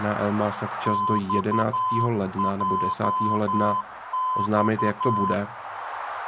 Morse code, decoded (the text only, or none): XJX